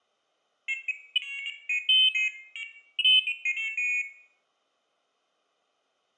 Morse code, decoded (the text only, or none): none